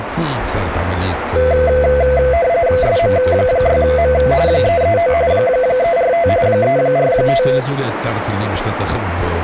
RTTY (45.45 baud, 170 Hz shift), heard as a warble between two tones, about 590 Hz centre, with radio static and a narrow filter. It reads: SM6M 339 345 345